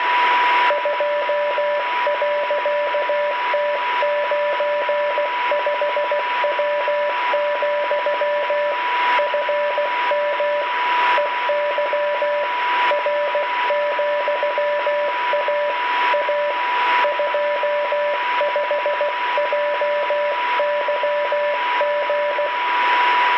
Morse code, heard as a keyed tone, hand-sent with a paddle, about 16 wpm, 590 Hz, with radio static, a steady whistle near 980 Hz and room echo. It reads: 2.T95W, FM EY R,A A 25JYG